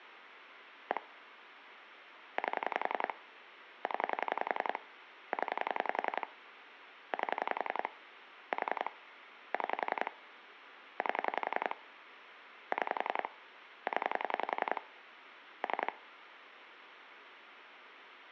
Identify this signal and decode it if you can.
Pulse dialling, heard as clicks on a phone line, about 11 pulses a second, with phone line noise. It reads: 1 8 0 0 8 4 6 8 6 0 3